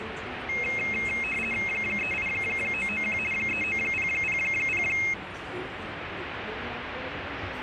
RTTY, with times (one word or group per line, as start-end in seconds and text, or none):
1.7-3.2 38991
3.3-4.8 39000